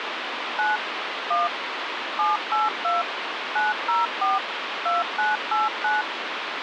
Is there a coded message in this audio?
Yes: DTMF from 0.6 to 6.0 s, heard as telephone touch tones, dialled by machine, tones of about 170 ms, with phone line noise. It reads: 9 1 782 904 2989